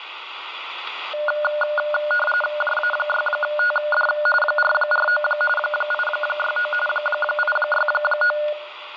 RTTY (45.45 baud, 850 Hz shift), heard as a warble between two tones, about 1020 Hz centre, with radio static. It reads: JA6TD 449 869 869